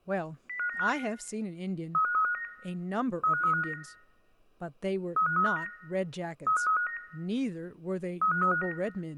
Five-tone selective call (CCIR), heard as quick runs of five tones, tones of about 100 ms, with speech in English. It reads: 05955 35359 35359 35359 35359 35359